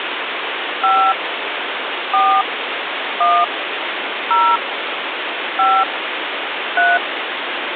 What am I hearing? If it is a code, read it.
DTMF, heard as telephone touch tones, dialled by hand, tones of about 210 ms, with phone line noise. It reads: 5 4 1 0 5 3